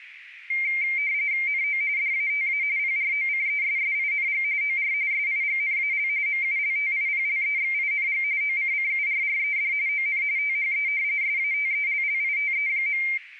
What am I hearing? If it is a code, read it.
RTTY (45.45 baud, 170 Hz shift), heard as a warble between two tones, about 2200 Hz centre, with radio static. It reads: NO DATA PROCESSING OR SIGNAL MULTIPLEXING OCCURRED ON THE SATELLITE.